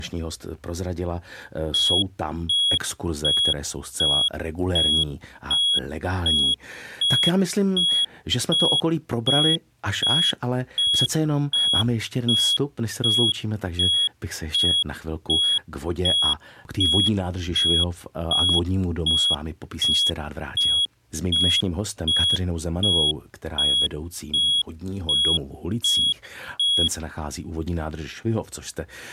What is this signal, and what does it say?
Evenly repeated beeps, with speech in Czech. There is no code.